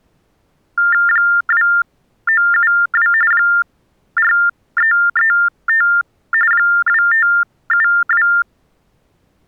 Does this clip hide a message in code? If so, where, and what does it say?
Yes: TTY/TDD text telephone tones (45.45 baud Baudot) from 0.8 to 8.4 s, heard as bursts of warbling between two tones, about 400 Hz shift, 1600 Hz centre. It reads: 2972 4335 2572